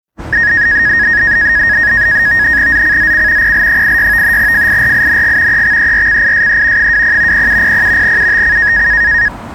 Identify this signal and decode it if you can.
NAVTEX (SITOR-B), 100 baud, 170 Hz shift, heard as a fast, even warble, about 1750 Hz centre, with street noise. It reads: ZCZC PL86 FIRING EXERCISE 20 0700 UTC